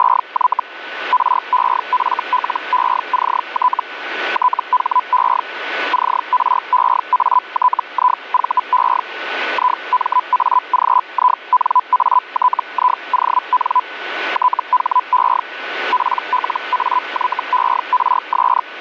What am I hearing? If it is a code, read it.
Hellschreiber (Feld-Hell, 122.5 baud), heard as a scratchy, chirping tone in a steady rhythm, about 1000 Hz, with radio static and a steady whistle near 1490 Hz. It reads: … REFLECT THE CREATIVE IMAGINATION THE PLAYERS